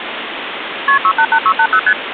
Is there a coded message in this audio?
Yes: multi-frequency trunk signalling (R1, as on North American trunks) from 0.9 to 1.9 s, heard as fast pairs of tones, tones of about 70 ms, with phone line noise. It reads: KP 688680 ST